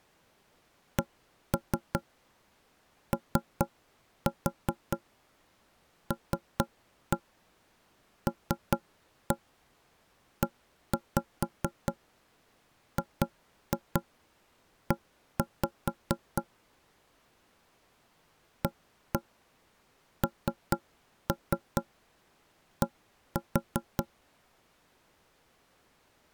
Tap code, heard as knocks on wood, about 4 knocks a second. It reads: COLLEGE AND